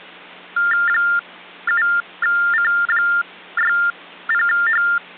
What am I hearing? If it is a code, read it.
TTY/TDD text telephone tones (45.45 baud Baudot), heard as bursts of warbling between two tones, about 400 Hz shift, 1600 Hz centre, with hum. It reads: 7C60H